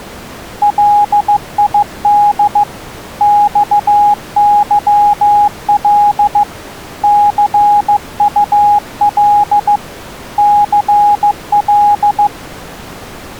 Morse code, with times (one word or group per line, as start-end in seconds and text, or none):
0.6-2.6 LID
3.2-6.4 XYL
7.0-9.8 CUL
10.4-12.3 CL